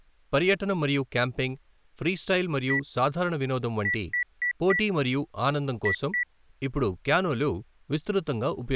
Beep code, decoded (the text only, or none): 1-4-2